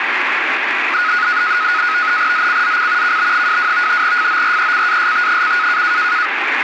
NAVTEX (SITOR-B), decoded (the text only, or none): ZCZC KB22 FORECAST: